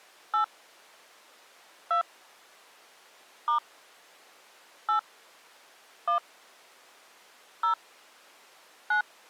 DTMF, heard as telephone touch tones, dialled by hand, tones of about 110 ms. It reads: 8 2 * 8 1 0 9